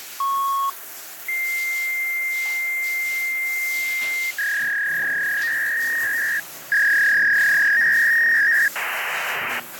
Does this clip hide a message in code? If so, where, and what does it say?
Yes: fax machine handshake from 0.2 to 9.6 s, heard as a beep, a long tone, a warble and hiss, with phone line noise and the noise of a restroom.